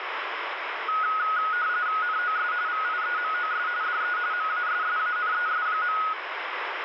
RTTY (45.45 baud, 170 Hz shift), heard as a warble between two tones, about 1360 Hz centre, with radio static. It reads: NOS VIEMOS DE MASSANES.